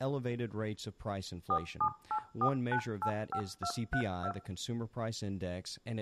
DTMF, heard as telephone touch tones, dialled by machine, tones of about 80 ms, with room echo and speech in English. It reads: 4784985232